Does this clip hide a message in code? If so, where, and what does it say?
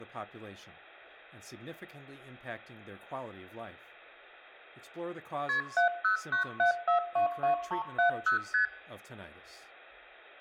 Yes: multi-frequency trunk signalling (R1, as on North American trunks) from 5.5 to 8.7 s, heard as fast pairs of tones, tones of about 110 ms, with hum, room echo and speech in English. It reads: KP 7097422370 ST